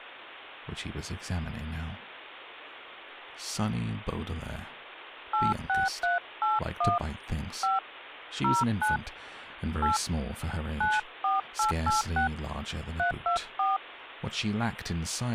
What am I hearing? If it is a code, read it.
DTMF, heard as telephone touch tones, dialled by hand, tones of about 150 ms, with speech in English. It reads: 86381 5 09 8 94886 324